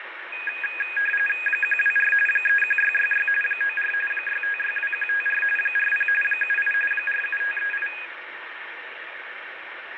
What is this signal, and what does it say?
RTTY (45.45 baud, 850 Hz shift), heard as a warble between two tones, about 2050 Hz centre, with radio static and fading. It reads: 124 31666 94 6562154 40 78 47538